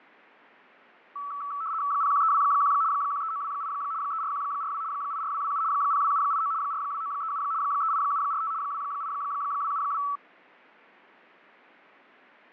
RTTY (75 baud, 170 Hz shift), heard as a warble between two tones, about 1230 Hz centre, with fading. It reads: 01321 13928 34142 84227 02789 42937 38745 28272